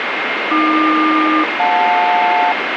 Aircraft SELCAL, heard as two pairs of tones, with radio static. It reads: AQ-JL